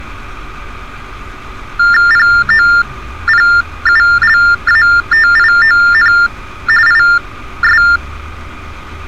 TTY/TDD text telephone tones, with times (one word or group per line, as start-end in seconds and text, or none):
2.1-6.1 POPULATION
6.9-7.8 IS